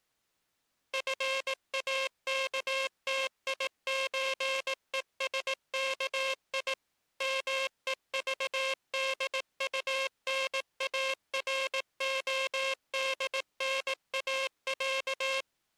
Morse code (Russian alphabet), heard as a buzzer, machine-sent, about 18 wpm. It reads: ФАКТИЧЕСКИ МЕЖДУНАРОДНАЯ